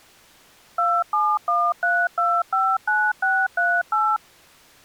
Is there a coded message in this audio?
Yes: DTMF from 0.8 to 4.2 s, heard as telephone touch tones, dialled by machine, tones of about 240 ms. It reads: 2713259638